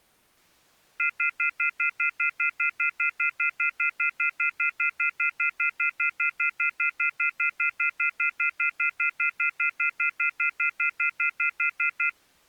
Telephone call progress tone (North American plan), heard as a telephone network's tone, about 1400, 2050, 2450, 2600 Hz, 0.1 s on and 0.1 s off. Off-hook warning tone.